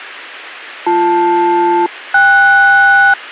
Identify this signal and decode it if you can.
Aircraft SELCAL, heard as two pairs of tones. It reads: BL-KS